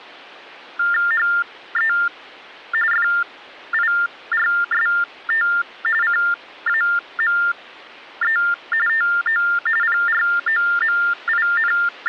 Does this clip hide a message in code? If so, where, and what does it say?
Yes: TTY/TDD text telephone tones (45.45 baud Baudot) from 0.8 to 12.1 s, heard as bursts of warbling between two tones, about 400 Hz shift, 1600 Hz centre. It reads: HE FIRST CAME TO …